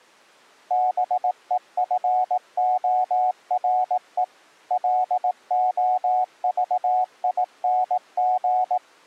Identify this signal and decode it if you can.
Morse code, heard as a keyed tone, machine-sent, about 18 wpm, 740 Hz. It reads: BEFORE LOVING